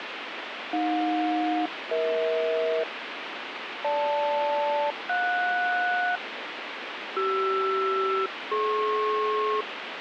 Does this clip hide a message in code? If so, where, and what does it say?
Yes: aircraft SELCAL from 0.7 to 9.6 s, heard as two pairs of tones, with radio static. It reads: AJ-EH GL-JS CR-DP